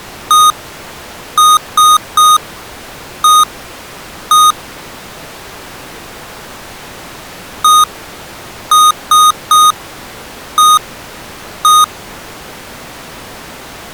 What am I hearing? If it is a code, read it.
Beep code, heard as beeps from a small speaker, played twice, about 1240 Hz. 1-3-1-1. In Phoenix BIOS tables: memory refresh test failure.